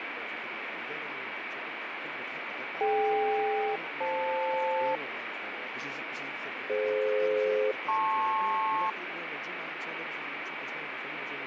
Aircraft SELCAL, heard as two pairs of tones, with radio static. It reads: DK-FL DF-LP